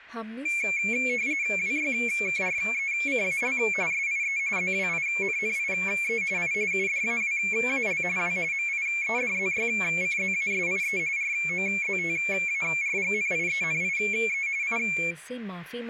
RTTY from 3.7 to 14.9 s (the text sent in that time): SIE ZWINNIE I UDAWAL W MIEDZYCZASIE ROZTARGNIENIE I